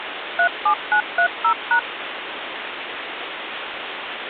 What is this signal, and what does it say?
DTMF, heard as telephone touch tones, dialled by machine, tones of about 90 ms, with phone line noise. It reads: 37930#